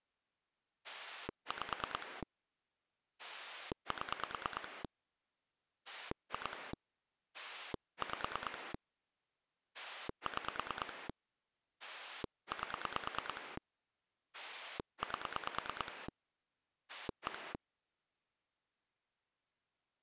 Pulse dialling, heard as a rotary dial, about 9 pulses a second. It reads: 5 7 2 5 6 8 8 1